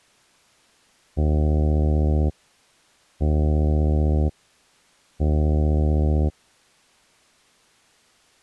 Ship horn signal, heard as a ship's horn, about 80 Hz. 3 short. At sea: I am operating astern propulsion.